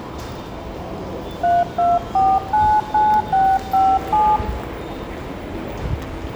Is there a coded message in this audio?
Yes: DTMF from 1.4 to 4.4 s, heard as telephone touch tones, dialled by hand, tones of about 240 ms, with a squelch burst at the end and the noise of a subway station. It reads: 32499657